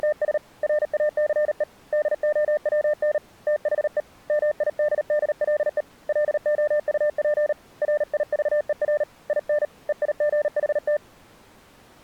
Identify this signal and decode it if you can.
Morse code, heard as a keyed tone, hand-sent with a paddle, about 38 wpm, 600 Hz. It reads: … RACE DOWN THE MIDDLE LOUP RIVER IN EIGHT